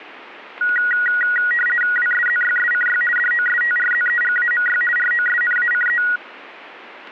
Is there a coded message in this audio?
Yes: RTTY (50 baud, 450 Hz shift) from 0.6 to 6.2 s, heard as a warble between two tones, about 1700 Hz centre. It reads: WSZYSCY DOSTRZEGAMY ROSNACE